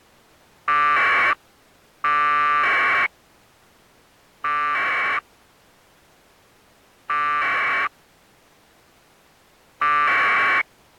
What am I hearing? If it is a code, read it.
Packet radio (AX.25, as in APRS), 1200 baud, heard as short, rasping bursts.